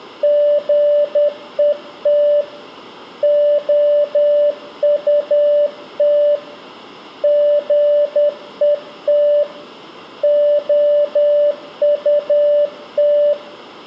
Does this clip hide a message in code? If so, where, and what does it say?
Yes: Morse code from 0.2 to 13.4 s, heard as a keyed tone, hand-sent with a paddle, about 10 wpm, 590 Hz, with room echo. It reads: GET OUT GET OUT